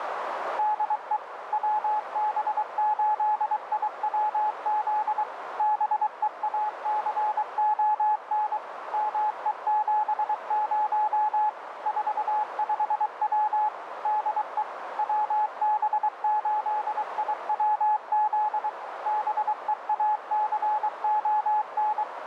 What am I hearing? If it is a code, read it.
Morse code, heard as a keyed tone, machine-sent, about 23 wpm, 850 Hz, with radio static and a narrow filter. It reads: DE WB8IWZ BEACON ME70 45W DE WB8IWZ BEACON